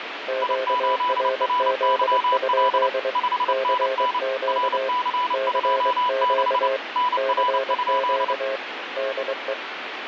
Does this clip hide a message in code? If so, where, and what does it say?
Yes: Morse code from 0.2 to 9.6 s, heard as two keyed tones, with radio static. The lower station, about 23 wpm, 530 Hz: QRZ? CQ CQ CQ DE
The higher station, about 29 wpm, 990 Hz: I8RYL 5NN RC26 NR?